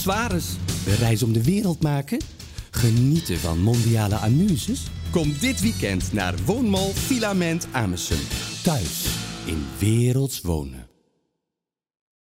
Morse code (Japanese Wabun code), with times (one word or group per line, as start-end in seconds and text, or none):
none